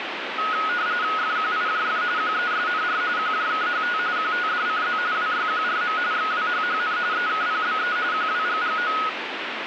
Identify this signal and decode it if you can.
RTTY (45.45 baud, 170 Hz shift), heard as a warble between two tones, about 1360 Hz centre, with radio static. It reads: FQIJF QESNR QJKHT QTDCZ WYQRM XWHHN EKPBE QWGGO